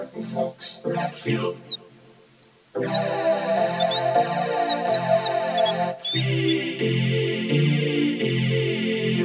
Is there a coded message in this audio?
No, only bird-like chirps.